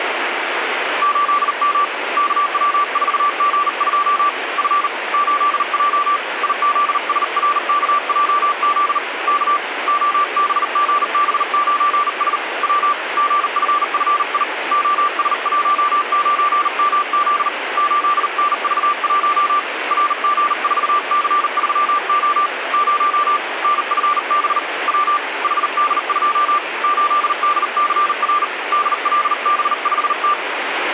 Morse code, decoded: 8M KW4G2 F 8J IZSRKJZ K OBGB9S W GFFI OS19MZ 8NV1 RG4C3O 0 NFB W HD2 8DCR DLB5T

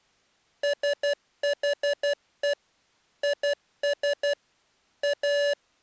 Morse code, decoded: SHE IS A

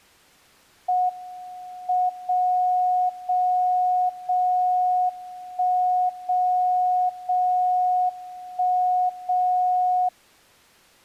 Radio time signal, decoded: M 0 0 0 1 0 0 1 0

